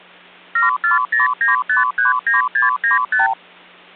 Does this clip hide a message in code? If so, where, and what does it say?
Yes: multi-frequency trunk signalling (R2, with the far end's replies) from 0.6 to 3.3 s, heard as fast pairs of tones, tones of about 140 ms, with hum. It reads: 7409539695